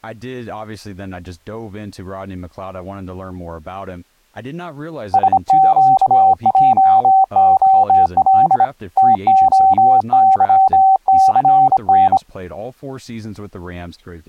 Morse code, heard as a keyed tone, hand-sent with a bug key, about 26 wpm, 770 Hz, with speech in English. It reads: SQJOL TOYCN